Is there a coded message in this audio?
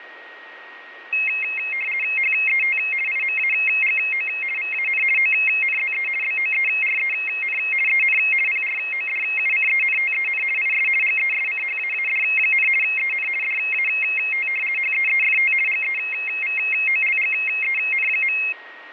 Yes: RTTY (50 baud, 450 Hz shift) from 1.1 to 18.5 s, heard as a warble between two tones, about 2350 Hz centre, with a steady whistle near 1880 Hz. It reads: HET IMAGO VAN ONZE BOEREN EN PRODUCENTEN IS GESCHAAD, EN DAT HEEFT GEVOLGEN.